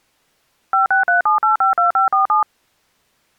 DTMF, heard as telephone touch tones, dialled by machine, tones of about 130 ms. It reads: 5637852547